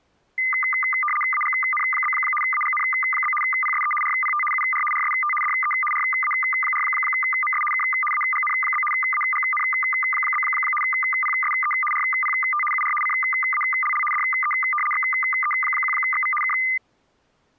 RTTY (75 baud, 850 Hz shift), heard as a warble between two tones, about 1600 Hz centre. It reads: AGN? AGN? PSE RPT UR RST DE RA4MS K AGN? AGN? PSE RPT UR CALL DE XE1XV K